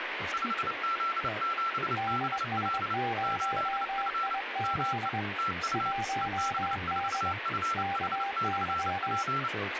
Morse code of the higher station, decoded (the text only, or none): 5Z7BL 8F ME TU EB4FH/P